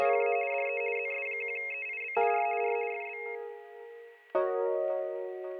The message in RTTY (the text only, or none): … DE ZS1EIB R R FB